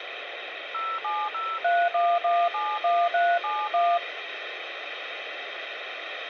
DTMF, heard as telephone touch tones, dialled by machine, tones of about 240 ms, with phone line noise. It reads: 07031171371